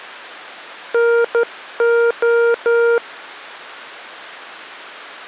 Morse code, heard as a keyed tone, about 12 wpm, 470 Hz. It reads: NO